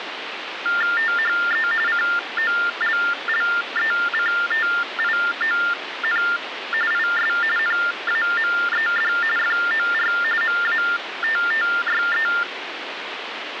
TTY/TDD text telephone tones (45.45 baud Baudot), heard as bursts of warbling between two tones, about 400 Hz shift, 1600 Hz centre, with phone line noise. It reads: THE COLLECTION IS NAMED FOR MATTYE